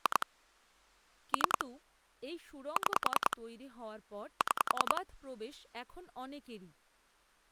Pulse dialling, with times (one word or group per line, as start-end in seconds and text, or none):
0.1-0.3 2
1.3-1.6 3
2.8-3.4 6
4.4-5.0 6